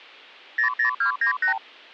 Multi-frequency trunk signalling (R2, with the far end's replies), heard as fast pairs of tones, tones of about 100 ms. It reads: 00298